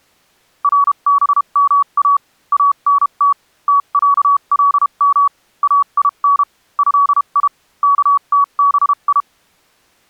Morse code (Arabic alphabet), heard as a keyed tone, machine-sent, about 32 wpm, spaced as for 28 wpm, 1130 Hz. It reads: ربما انت تعلم اين هي كتبي